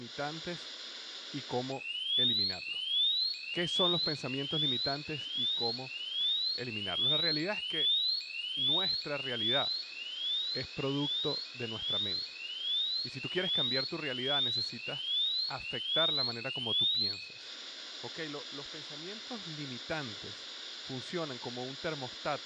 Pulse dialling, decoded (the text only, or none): none